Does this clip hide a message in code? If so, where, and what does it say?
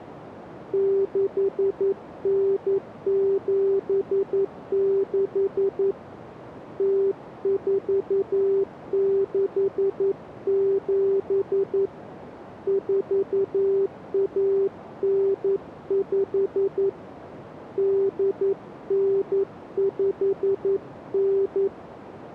Yes: Morse code (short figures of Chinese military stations) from 0.7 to 21.7 s, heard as a keyed tone, hand-sent with a paddle, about 11 wpm, 390 Hz, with radio static. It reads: 6976 0467 4195 8959